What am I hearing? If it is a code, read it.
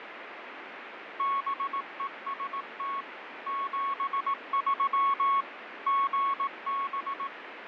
Morse code, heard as a keyed tone, machine-sent, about 18 wpm, 1100 Hz, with radio static and fading. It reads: BEST 73 GB